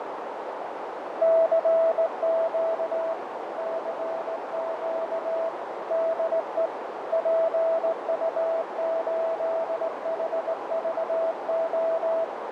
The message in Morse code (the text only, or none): CQ CQ DE PU8HVO